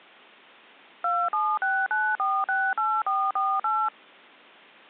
DTMF, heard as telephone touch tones, dialled by machine, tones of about 240 ms. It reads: 2769468448